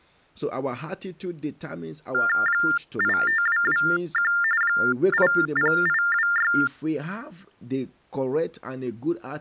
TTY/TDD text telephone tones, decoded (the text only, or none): 85221 80826